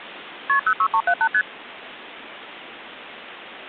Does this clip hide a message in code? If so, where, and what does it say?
Yes: multi-frequency trunk signalling (R1, as on North American trunks) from 0.5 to 1.4 s, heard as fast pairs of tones, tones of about 70 ms. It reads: KP 06378 ST